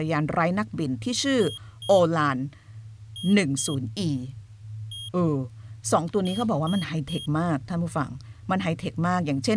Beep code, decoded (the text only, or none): 2-2-1-3